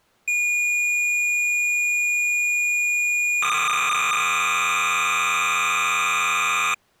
Cassette data (Kansas City type), 300 baud, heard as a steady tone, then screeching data.